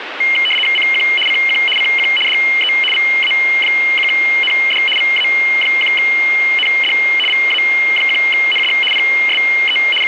RTTY (75 baud, 850 Hz shift), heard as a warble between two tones, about 2550 Hz centre, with radio static. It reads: CQ CQ CQ DE VA1ND VA1ND VA1ND PSE …